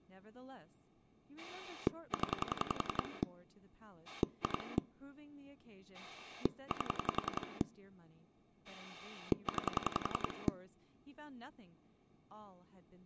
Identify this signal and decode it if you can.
Pulse dialling, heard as a rotary dial, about 11 pulses a second, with speech in English. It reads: 0 2 8 9